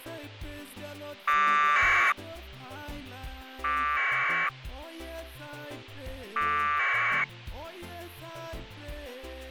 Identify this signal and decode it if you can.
Packet radio (AX.25, as in APRS), 1200 baud, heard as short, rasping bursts.